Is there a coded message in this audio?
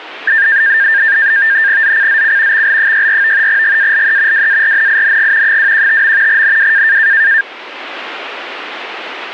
Yes: NAVTEX (SITOR-B), 100 baud, 170 Hz shift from 0.3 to 7.4 s, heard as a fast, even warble, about 1700 Hz centre. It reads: ZCZC XL64 GALE WARNING 215. NW